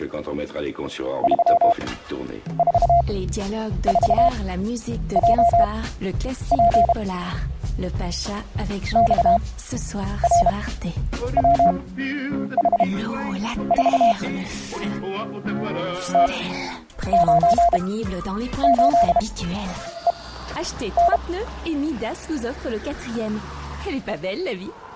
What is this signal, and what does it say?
Morse code, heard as a keyed tone, machine-sent, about 32 wpm, spaced as for 9 wpm, 690 Hz. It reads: 344JP XRWH4 T98EN